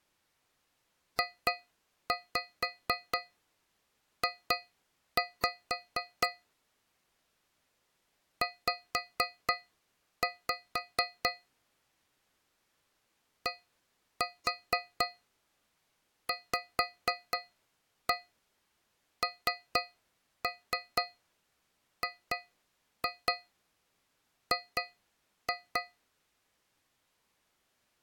Tap code, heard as taps on a metal pipe, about 4 knocks a second. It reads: JJ Z DVNGG